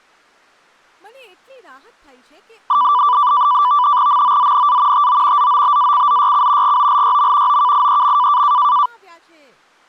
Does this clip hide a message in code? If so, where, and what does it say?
Yes: NAVTEX (SITOR-B), 100 baud, 170 Hz shift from 2.7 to 8.9 s, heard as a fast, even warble, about 1080 Hz centre, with speech in Gujarati. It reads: MOZNA TO ZOBACZYC GOLYM OKIEM